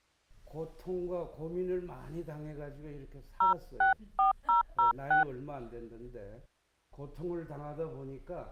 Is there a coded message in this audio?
Yes: DTMF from 3.4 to 5.2 s, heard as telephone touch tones, dialled by hand, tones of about 130 ms. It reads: 064006